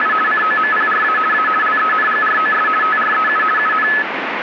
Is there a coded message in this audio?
Yes: RTTY (50 baud, 450 Hz shift) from 0.0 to 4.0 s, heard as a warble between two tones, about 1500 Hz centre, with radio static. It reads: … COMPRA A LENGROS TREU UN